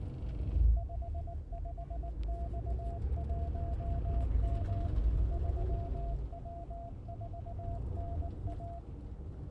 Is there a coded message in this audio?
Yes: Morse code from 0.7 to 8.8 s, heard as a keyed tone, machine-sent, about 19 wpm, 680 Hz, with the noise inside a bus. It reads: 55X1M 3W4NA